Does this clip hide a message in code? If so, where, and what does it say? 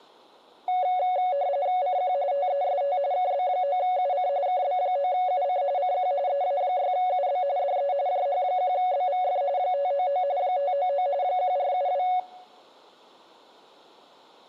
Yes: RTTY (45.45 baud, 170 Hz shift) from 0.7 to 12.2 s, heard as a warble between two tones, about 650 Hz centre. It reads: CQ TEST KB9UC KB9UC CQ EA6UB DE JH1BVF 599 599 1472